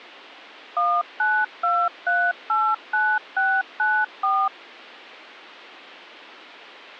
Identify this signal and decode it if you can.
DTMF, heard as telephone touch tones, dialled by machine, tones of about 250 ms. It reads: 192389694